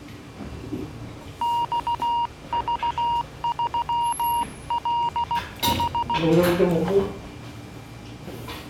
Morse code, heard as a keyed tone, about 16 wpm, 940 Hz, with the noise of a restaurant. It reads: XV3LH